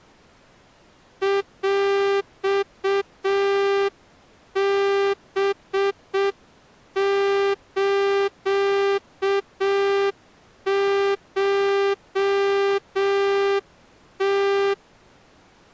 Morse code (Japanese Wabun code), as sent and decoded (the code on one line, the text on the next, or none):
.-..- -... ---.- ---- -
ヰハスコム